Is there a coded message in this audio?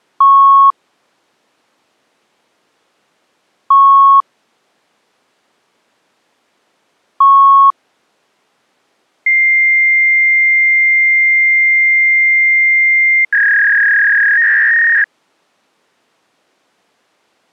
Yes: fax machine handshake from 0.2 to 15.0 s, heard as beeps, a long tone and a warble.